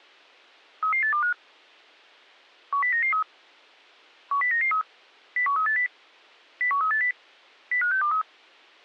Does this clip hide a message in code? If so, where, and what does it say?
Yes: five-tone selective call (CCIR) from 0.8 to 8.2 s, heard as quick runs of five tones, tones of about 100 ms. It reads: 33825 10993 10993 01380 01380 05623